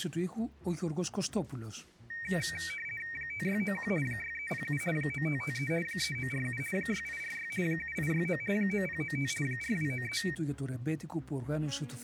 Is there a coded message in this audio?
Yes: RTTY (50 baud, 450 Hz shift) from 2.1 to 10.4 s, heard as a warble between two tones, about 2100 Hz centre. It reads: 5691 6307 9553 3947 6846 7869 9095 4293